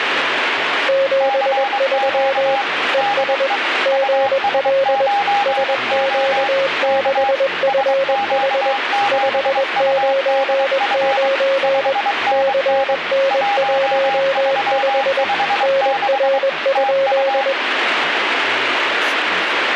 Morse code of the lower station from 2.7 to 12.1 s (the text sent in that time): ES GL SQ6FH 599